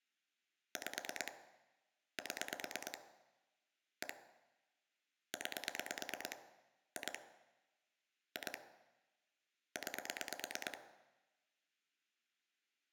Pulse dialling, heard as clicks on a phone line, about 9 pulses a second, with room echo. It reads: 5 7 1 9 2 2 9